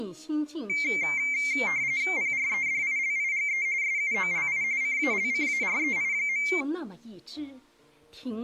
RTTY (45.45 baud, 170 Hz shift), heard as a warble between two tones, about 2200 Hz centre. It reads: PREDILIGE SUOLI CALCAREI.